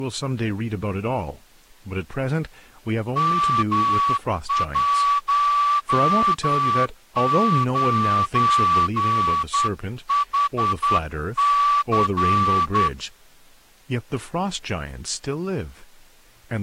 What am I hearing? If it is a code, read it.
Morse code, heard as a whistle, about 10 wpm, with speech in English. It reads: M19HC